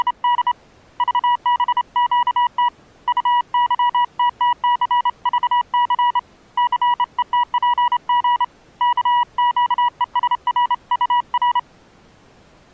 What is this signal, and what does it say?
Morse code, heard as a keyed tone, hand-sent with a straight key, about 28 wpm, 970 Hz. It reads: … VBQT UYTTCVC CETPG KQESRUR